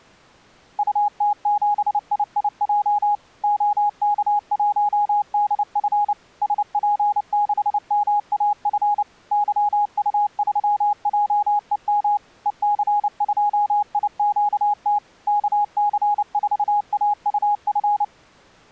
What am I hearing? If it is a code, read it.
Morse code, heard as a keyed tone, machine-sent, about 29 wpm, 830 Hz. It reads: UT7IIJ OK1DF SP6MAF YU3JEM EC2IQT KC4AUF